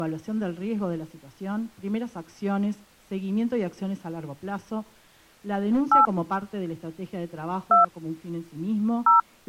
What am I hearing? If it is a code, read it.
DTMF, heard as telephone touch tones, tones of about 140 ms. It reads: 8 2 0